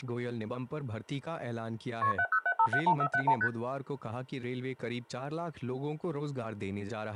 Multi-frequency trunk signalling (R1, as on North American trunks), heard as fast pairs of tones, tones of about 70 ms. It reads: KP 707571471 ST